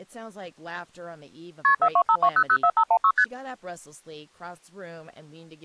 Multi-frequency trunk signalling (R1, as on North American trunks), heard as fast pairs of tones, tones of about 70 ms, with speech in English. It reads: KP 4252004516 ST